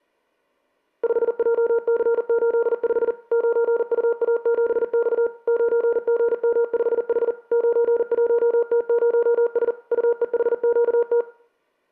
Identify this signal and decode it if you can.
Morse code, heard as a keyed tone, machine-sent, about 40 wpm, 470 Hz. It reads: 5JC85 9UA7X 9GM5H 91T0S UEHQT